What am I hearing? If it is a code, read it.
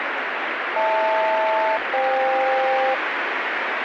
Aircraft SELCAL, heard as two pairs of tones, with radio static. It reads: HL-FK